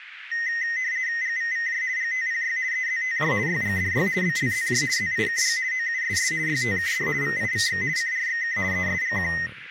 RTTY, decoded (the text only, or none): GVVJ GTPY EZTJ YGDY BLZJ ZIKG OUSS YTKD VIVX CRXK ESGQ